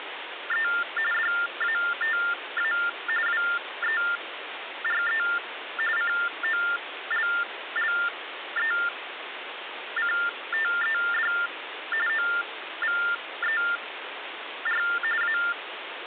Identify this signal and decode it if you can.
TTY/TDD text telephone tones (45.45 baud Baudot), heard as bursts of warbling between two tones, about 400 Hz shift, 1600 Hz centre, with phone line noise. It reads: … DATA WERE COLLECTED OVER A